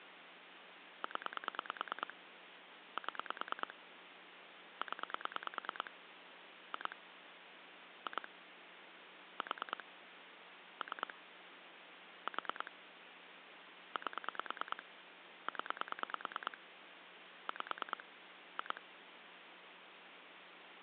Pulse dialling, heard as clicks on a phone line, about 9 pulses a second, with phone line noise. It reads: 0 7 0 2 2 4 3 4 8 0 5 2